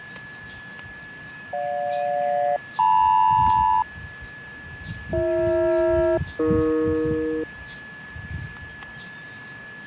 Aircraft SELCAL, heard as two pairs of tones, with fading, static crashes, a steady whistle near 1710 Hz and the noise of a park. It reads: GJ-LM BH-AE